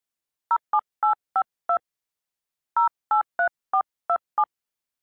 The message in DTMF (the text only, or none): 07852 083427